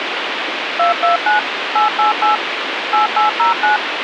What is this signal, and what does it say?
DTMF, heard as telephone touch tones, dialled by machine, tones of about 130 ms, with radio hiss. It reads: 229 888 8809